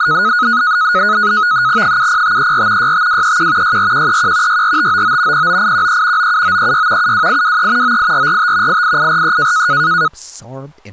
NAVTEX (SITOR-B), 100 baud, 170 Hz shift, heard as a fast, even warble, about 1360 Hz centre, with speech in English. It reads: 70534 65231 64131 64599 09813 97936 72823 98445 88843